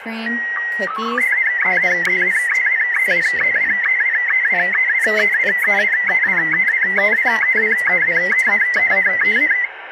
SSTV (slow-scan television), Martin M1, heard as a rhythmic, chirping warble, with radio static and speech in English.